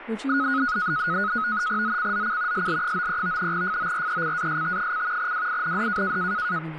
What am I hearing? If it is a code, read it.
NAVTEX (SITOR-B), 100 baud, 170 Hz shift, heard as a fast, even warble, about 1360 Hz centre, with radio static and speech in English. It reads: ZCZC SL93 FORECAST: WIND